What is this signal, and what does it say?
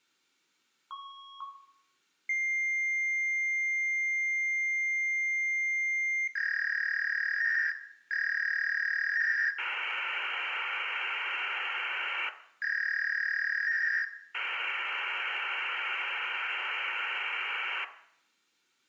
Fax machine handshake, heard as a beep, a long tone, a warble and hiss, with room echo.